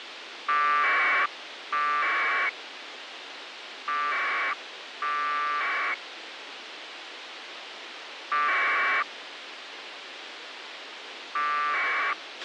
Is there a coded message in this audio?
Yes: packet radio (AX.25, as in APRS), 1200 baud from 0.5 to 12.1 s, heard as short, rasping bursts, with radio hiss and a squelch burst at the end.